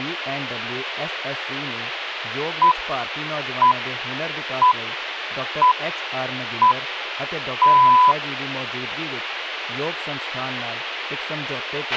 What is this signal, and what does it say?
Radio time signal (six pips, as the Greenwich Time Signal), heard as pips, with radio hiss, a squelch burst at the end and speech in Punjabi.